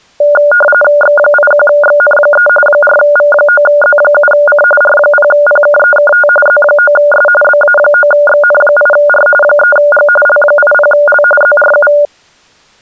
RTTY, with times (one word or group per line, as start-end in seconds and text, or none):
1.0-2.5 X81XN3
2.7-4.6 4V9Z7C
4.8-6.3 R0PKEKT
6.5-7.3 Z9S
7.4-9.3 BA9XN8R
9.4-10.1 3G
10.3-11.2 L80L
11.4-11.9 ZRU